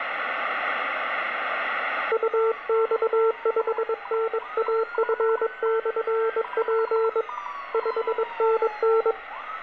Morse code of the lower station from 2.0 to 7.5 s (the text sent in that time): UX5NAF/P